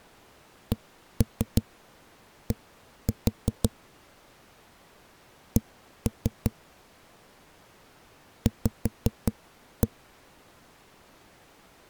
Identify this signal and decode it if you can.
Tap code, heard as knocks on a wall, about 5 knocks a second. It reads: CD C V